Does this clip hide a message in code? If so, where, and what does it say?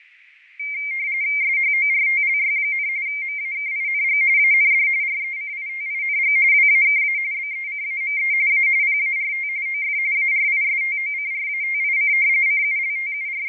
Yes: RTTY (45.45 baud, 170 Hz shift) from 0.6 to 13.5 s, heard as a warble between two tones, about 2200 Hz centre, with radio static and fading. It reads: SHORTLY, MAKING AND RECITING WAKA BECAME A PART OF ARISTOCRATIC …